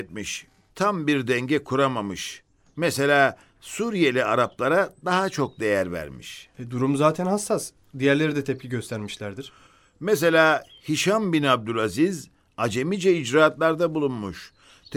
Speech in Turkish. There is no code.